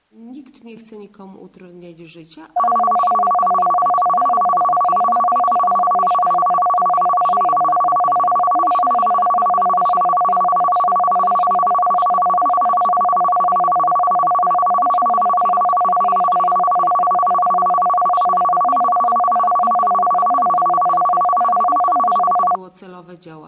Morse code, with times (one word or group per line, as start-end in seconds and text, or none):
none